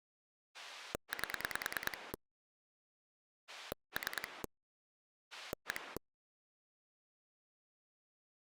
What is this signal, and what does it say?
Pulse dialling, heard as a rotary dial, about 9 pulses a second. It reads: 8 3 1